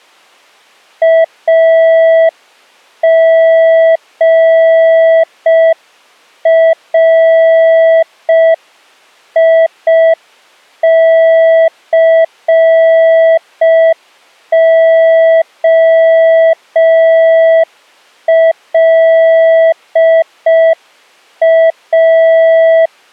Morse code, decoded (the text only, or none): AGRICOLA